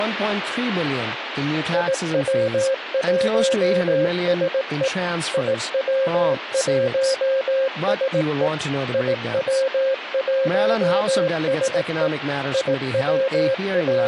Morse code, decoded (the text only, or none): IW1SE IW1SE IW1SE …